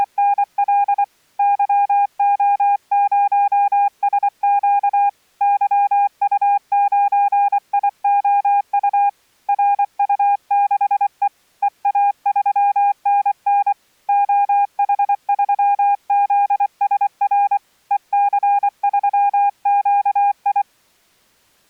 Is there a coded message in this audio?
Yes: Morse code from 0.0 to 20.7 s, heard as a keyed tone, hand-sent with a paddle, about 24 wpm, 810 Hz. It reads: … YO0SQ YU9IOU RU6E EA3NN OH3ZSR EC3QI